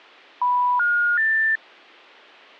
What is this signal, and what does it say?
Telephone call progress tone (North American plan), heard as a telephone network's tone, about 980, 1430, 1800 Hz. Special information tone.